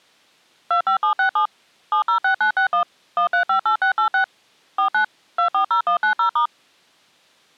DTMF, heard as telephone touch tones, dialled by machine, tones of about 100 ms. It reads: 25767 706961 1358686 49 240190*